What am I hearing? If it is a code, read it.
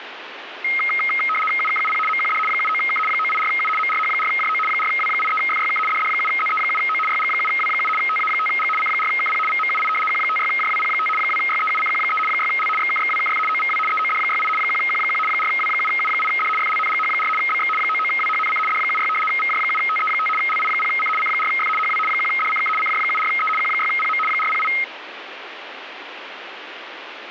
RTTY (75 baud, 850 Hz shift), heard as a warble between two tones, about 1700 Hz centre, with radio static. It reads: UKUP MQD 79K 984U MRH4JO 4W83FYK DD7ZE7O YG7W7 TA5G C4KP VMUI Q56JWP5 2YEUCQ3 6L XKXWKF OVW EOD68 1Q1 4W7U8D FLNGH4 BX 99WHNC D76 VJ7TE5 LI0C C4F HW 1DCK CJ74E Q6PM 408